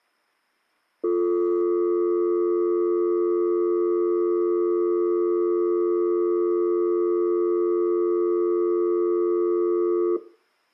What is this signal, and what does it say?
Telephone call progress tone (North American or UK plan), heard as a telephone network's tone, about 350, 440 Hz, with room echo. Dial tone.